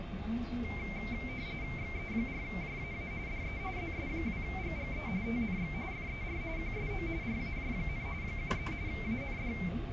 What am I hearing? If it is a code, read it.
RTTY (45.45 baud, 170 Hz shift), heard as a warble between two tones, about 2200 Hz centre, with radio static, a steady whistle near 690 Hz and the noise inside a bus. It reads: XE4JAA DE ZS2GGE TNX FER QSO RAJ, 73 AND